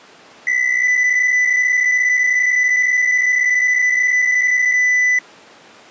PSK63 (62.5 baud), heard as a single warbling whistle, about 2000 Hz.